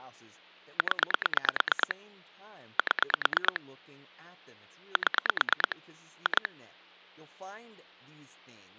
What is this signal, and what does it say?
Pulse dialling, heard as clicks on a phone line, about 9 pulses a second, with hum and speech in English. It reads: 0 7 7 2